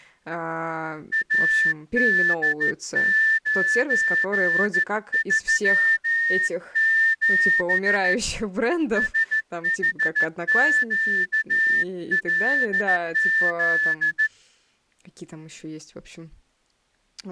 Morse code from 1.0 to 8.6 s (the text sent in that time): AD937